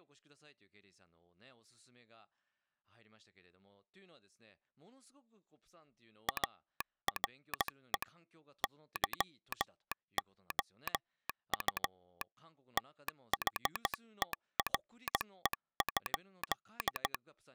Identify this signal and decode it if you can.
Morse code, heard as a telegraph sounder, hand-sent with a straight key, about 15 wpm, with speech in Japanese. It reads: ARE YOU THERE?